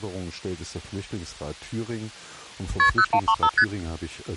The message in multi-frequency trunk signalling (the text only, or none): KP 0135 ST